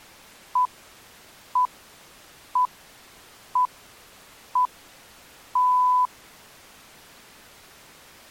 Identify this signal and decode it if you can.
Radio time signal (six pips, as the Greenwich Time Signal), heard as pips.